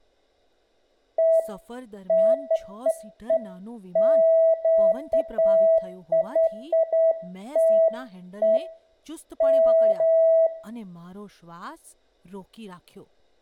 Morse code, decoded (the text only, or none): none